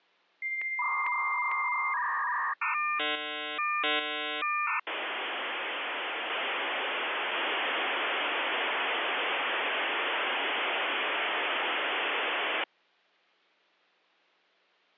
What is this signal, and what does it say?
Dial-up modem handshake (V.34 or later), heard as a whistle, warbles, then hiss.